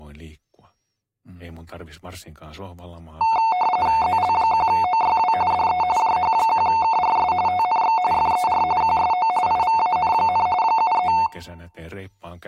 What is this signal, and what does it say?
RTTY (45.45 baud, 170 Hz shift), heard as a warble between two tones, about 810 Hz centre, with speech in Finnish. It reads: ZL1OYW DE JH1KRS TNX FER QSO IVAN, 73